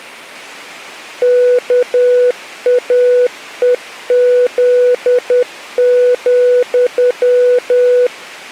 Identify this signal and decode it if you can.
Morse code, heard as a keyed tone, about 10 wpm, 490 Hz. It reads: KAEZ,